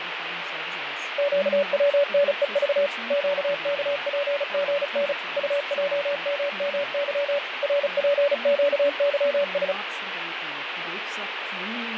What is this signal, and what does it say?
Morse code, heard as a keyed tone, machine-sent, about 35 wpm, 570 Hz, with radio static, fading and speech in English. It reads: QWNEV QKPGN UJMMY RPQYS